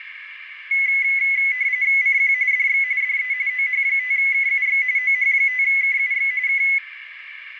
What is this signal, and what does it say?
RTTY (45.45 baud, 170 Hz shift), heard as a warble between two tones, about 2100 Hz centre, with radio static and a narrow filter. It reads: CQ DX DE OH5KUX OH5KUX K